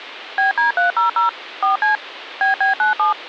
DTMF, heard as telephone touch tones, dialled by machine, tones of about 130 ms. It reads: BD300 4C BB97